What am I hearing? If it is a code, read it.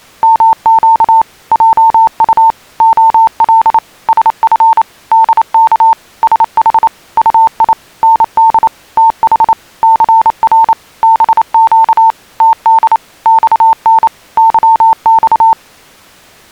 Morse code, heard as a keyed tone, machine-sent, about 28 wpm, 900 Hz. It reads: MQ JU OL SF DK SH UI ND TH CR BQ TD XN YX